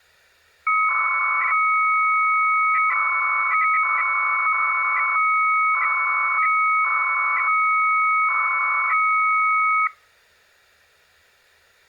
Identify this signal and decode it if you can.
300-baud modem data (Bell 103 tones), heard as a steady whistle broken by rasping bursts, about 300 baud, 200 Hz shift.